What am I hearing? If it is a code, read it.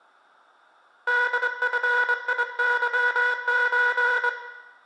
Morse code (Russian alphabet), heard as a buzzer, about 24 wpm, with room echo. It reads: ДФИЫЧ